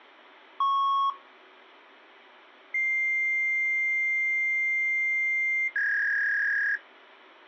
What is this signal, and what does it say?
Fax machine handshake, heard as a beep, a long tone and a warble.